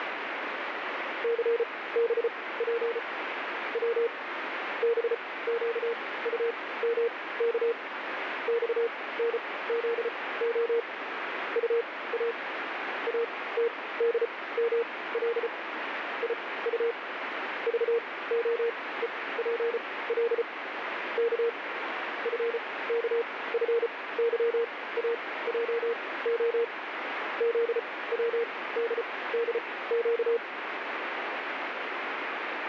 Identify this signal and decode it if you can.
Morse code, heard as a keyed tone, machine-sent, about 34 wpm, spaced as for 19 wpm, 470 Hz, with radio static. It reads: CBP W BQUMK XNZO UA ATDML IU VOEPL K FKFYAJO ZWDDQ